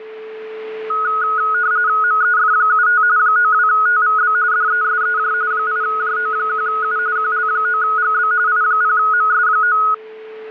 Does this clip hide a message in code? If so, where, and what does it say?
Yes: RTTY (45.45 baud, 170 Hz shift) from 0.9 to 9.9 s, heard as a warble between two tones, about 1360 Hz centre, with a steady whistle near 440 Hz. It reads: MEF75 92TVB DESEJ 8JO1U QL9GB I0MS9